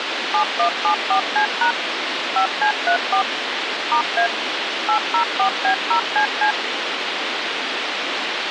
DTMF, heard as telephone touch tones, dialled by machine, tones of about 100 ms, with radio hiss. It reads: 7174C# 5C34 *A 804B0CC